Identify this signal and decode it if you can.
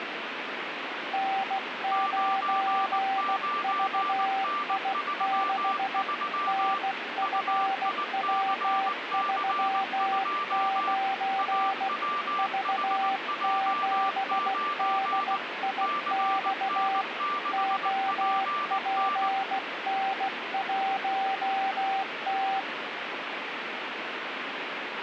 Morse code, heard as two keyed tones, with radio static. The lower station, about 16 wpm, 780 Hz: N9VI6 NFW39 V7DIX OPN1T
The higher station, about 19 wpm, 1180 Hz: 99N33 UICC2 AWHJ9 CN6PN